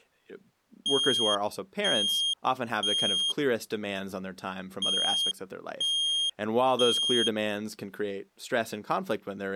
Alarm pattern, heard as an alarm's beeps, played twice, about 3250 Hz, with speech in English. Temporal three. Smoke or fire, evacuate.